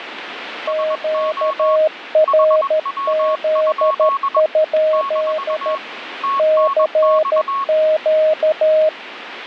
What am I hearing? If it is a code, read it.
Morse code, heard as two keyed tones, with radio static. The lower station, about 13 wpm, 620 Hz: QRZ? CQ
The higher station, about 21 wpm, 1100 Hz: SO HW? - TNX